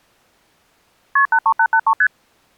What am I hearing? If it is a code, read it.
Multi-frequency trunk signalling (R1, as on North American trunks), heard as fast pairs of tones, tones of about 70 ms. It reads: KP 83883 ST